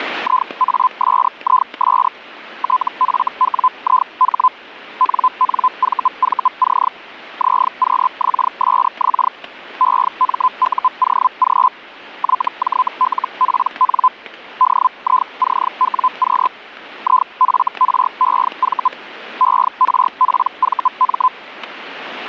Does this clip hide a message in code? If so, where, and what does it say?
Yes: Hellschreiber (Feld-Hell, 122.5 baud) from 0.2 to 21.3 s, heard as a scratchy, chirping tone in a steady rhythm, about 1020 Hz, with static crashes. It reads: IASIS TFWIH NNVVC ZQXSX EMUOG YJLPN DICWQ IFREV ERPVM